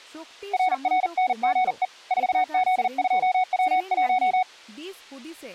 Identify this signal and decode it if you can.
Morse code, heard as a keyed tone, hand-sent with a paddle, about 40 wpm, 740 Hz, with speech in Santali. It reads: RRNGE 4Z2W1